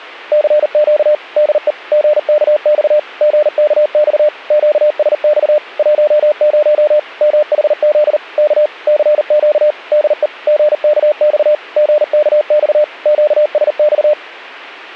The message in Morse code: CQ DE GKX GKX QSX 10 MHZ K CQ DE GKX GKX QSX

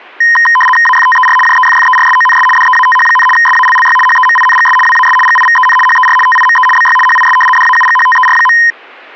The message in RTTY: AFTER JEFFERSONS DEATH, SALLY HEMINGS WAS GIVEN HER TIME BY HIS DAUGHTER.

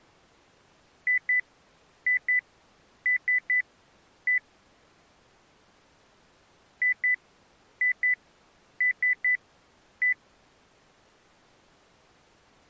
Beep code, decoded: 2-2-3-1

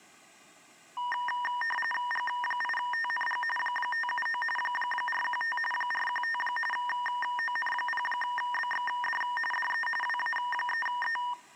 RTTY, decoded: G8TNG 579 415 415 ON0BXD DE WA3E

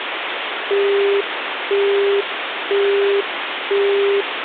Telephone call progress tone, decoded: busy tone

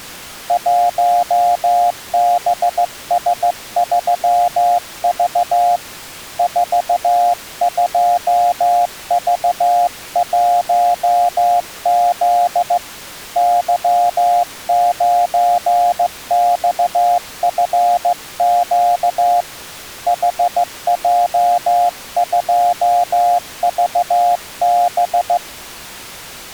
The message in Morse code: 1BS3V 42V1Z Y9XFQ HJ2VB

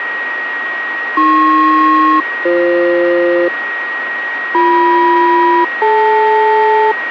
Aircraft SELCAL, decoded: AP-BF BM-DL

